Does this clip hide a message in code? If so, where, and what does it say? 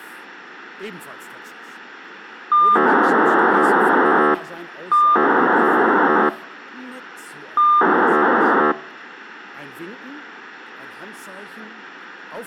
Yes: POCSAG pager data (2400 baud) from 2.5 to 8.7 s, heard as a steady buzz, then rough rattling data, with radio hiss.